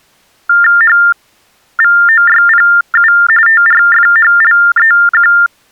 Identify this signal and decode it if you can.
TTY/TDD text telephone tones (45.45 baud Baudot), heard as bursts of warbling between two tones, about 400 Hz shift, 1600 Hz centre. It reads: HVOYPU TRFHLEQ